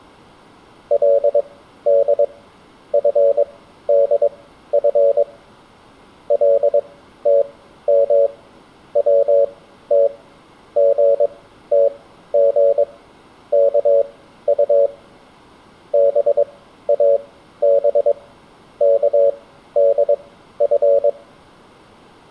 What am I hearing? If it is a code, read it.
Morse code (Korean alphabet), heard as a keyed tone, machine-sent, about 22 wpm, spaced as for 13 wpm, 560 Hz, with room echo. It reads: 그는 검버섯이 돋은